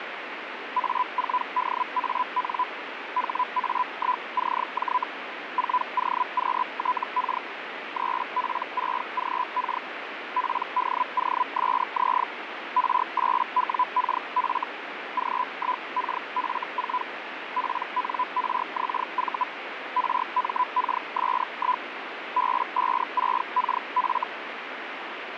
Hellschreiber (Feld-Hell, 122.5 baud), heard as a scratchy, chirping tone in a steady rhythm, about 1000 Hz, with radio static. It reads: A4DAN HA1CJ 4OQTK 3P6GK PDOSZ R8WKF G1KF4 PNRXV RMKS1 B56KF